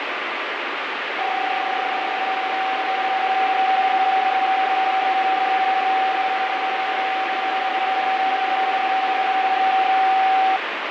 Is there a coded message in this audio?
Yes: PSK31 (31.25 baud) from 1.2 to 10.6 s, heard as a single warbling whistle, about 760 Hz, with radio static.